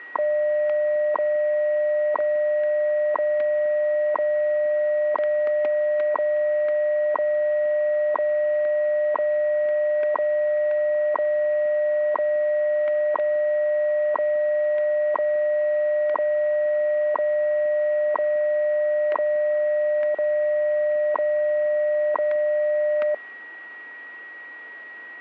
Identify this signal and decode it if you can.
Radio time signal (WWV, Colorado), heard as ticks, one a second, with static crashes and a steady whistle near 1910 Hz.